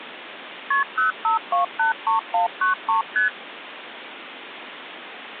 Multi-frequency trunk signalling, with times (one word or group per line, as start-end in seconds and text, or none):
0.7-0.8 KP
1.0-3.0 05283193
3.2-3.3 ST